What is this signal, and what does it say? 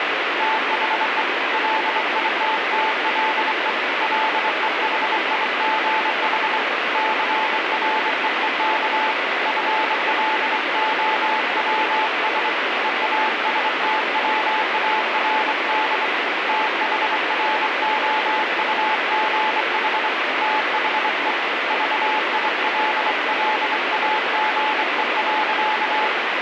Morse code, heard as a keyed tone, hand-sent with a straight key, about 24 wpm, 870 Hz, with heavy radio static. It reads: THE LITTLE LEHIGH CREEK FLOWS EASTWARD THROUGH THE VILLAGE.